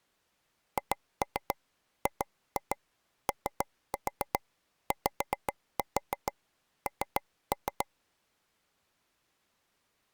Tap code, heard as taps on a table, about 7 knocks a second. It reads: HGOYN